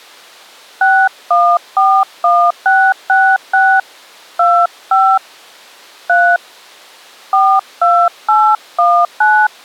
DTMF, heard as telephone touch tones, dialled by hand, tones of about 270 ms. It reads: 6141666 25 3 42819